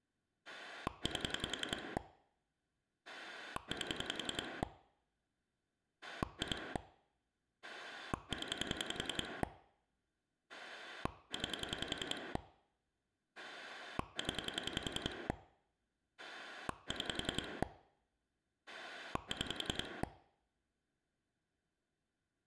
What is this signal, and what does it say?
Pulse dialling, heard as a rotary dial, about 10 pulses a second. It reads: 8 8 2 0 9 0 6 6